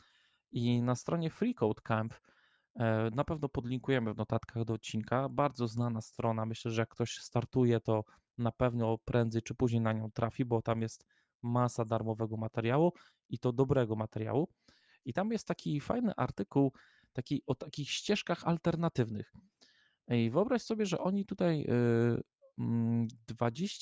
Speech in Polish. There is no code.